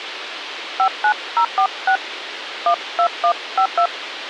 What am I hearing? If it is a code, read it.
DTMF, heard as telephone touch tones, dialled by hand, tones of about 80 ms, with radio hiss. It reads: 59046 12152